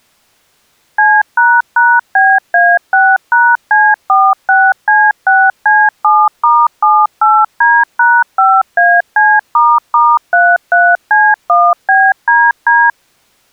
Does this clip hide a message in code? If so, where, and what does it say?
Yes: DTMF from 1.0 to 12.9 s, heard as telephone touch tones, dialled by machine, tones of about 230 ms. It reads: C##BA6#C46C6C7*78D#5AC**33C1BDD